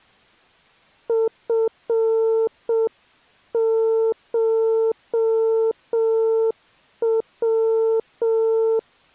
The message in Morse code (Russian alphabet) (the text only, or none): ФШВ